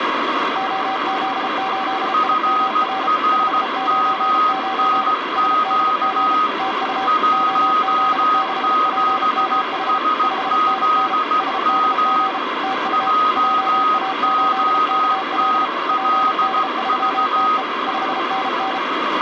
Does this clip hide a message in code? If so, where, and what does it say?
Yes: Morse code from 0.5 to 18.8 s, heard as two keyed tones, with radio static. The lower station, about 33 wpm, 770 Hz: OZ8IMR 599 SDG TU OZ6PMH 5NN SDG TU JA8KL PD3TE 5NN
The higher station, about 16 wpm, 1250 Hz: FRMNQ 17SZM JOTLV